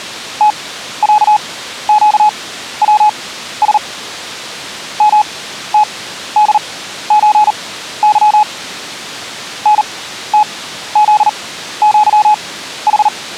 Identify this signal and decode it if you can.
Morse code (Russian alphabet), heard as a keyed tone, machine-sent, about 39 wpm, spaced as for 14 wpm, 850 Hz. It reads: ТЯЩВС МТДЧЫ НТЗЪХ